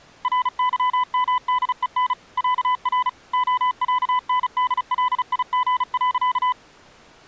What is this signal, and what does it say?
Morse code (with Swedish letters), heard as a keyed tone, machine-sent, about 35 wpm, 1000 Hz. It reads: RYMDEN ÄR OÄNDLIG.